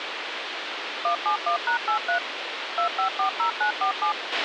DTMF, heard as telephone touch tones, dialled by machine, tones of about 100 ms, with radio hiss and a squelch burst at the end. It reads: 171#83 2540947